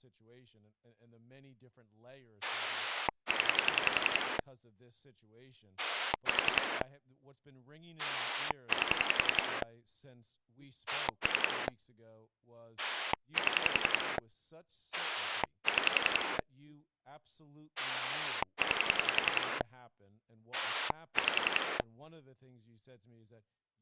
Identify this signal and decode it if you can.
Pulse dialling, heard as a rotary dial, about 11 pulses a second, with speech in English. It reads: 0 4 8 3 7 6 9 5